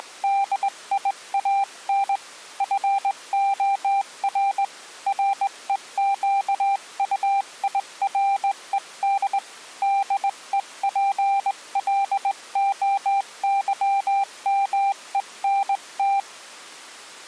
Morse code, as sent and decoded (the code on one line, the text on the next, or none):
… / ..-. --- .-. / .-. . --.- ..- .. .-. . -.. / -.. . .--. .-.. --- -.-- -- . -. -
… FOR REQUIRED DEPLOYMENT